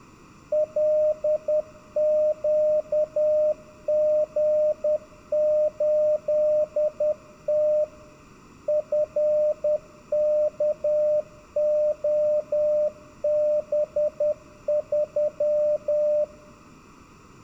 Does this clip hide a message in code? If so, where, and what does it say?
Yes: Morse code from 0.5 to 16.3 s, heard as a keyed tone, machine-sent, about 10 wpm, 600 Hz, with room echo. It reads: LQG8T FKOB3